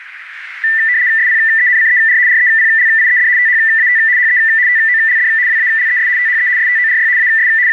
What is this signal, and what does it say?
RTTY (75 baud, 170 Hz shift), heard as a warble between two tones, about 1900 Hz centre, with radio static and a narrow filter. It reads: SPENCER REPLIED THAT HE TOLD WALES THE STORY AS …